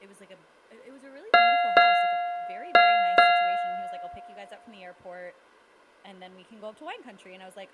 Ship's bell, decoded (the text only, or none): 4